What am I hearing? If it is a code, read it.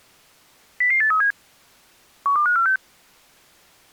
Five-tone selective call (CCIR), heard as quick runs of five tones, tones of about 100 ms. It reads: 00837 12546